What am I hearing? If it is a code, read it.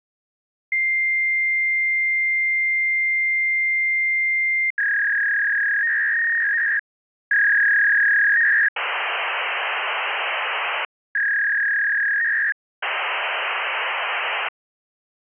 Fax machine handshake, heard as a long tone, a warble and hiss.